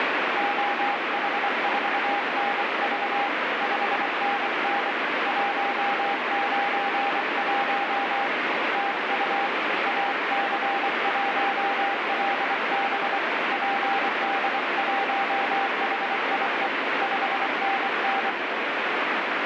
Morse code, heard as a keyed tone, hand-sent with a paddle, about 24 wpm, 800 Hz, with heavy radio static. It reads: OH4NV 5NN 191 TU AC1LB PD1HIE 5NN